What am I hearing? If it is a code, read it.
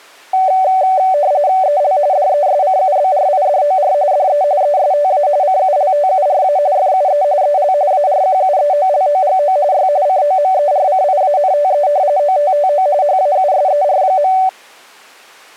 RTTY (45.45 baud, 170 Hz shift), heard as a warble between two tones, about 670 Hz centre. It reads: EL DESCUBRIDOR DE ESTA CULTURA FUE EL ARQUEOLOGO Y COMERCIANTE OTTO HAUSER.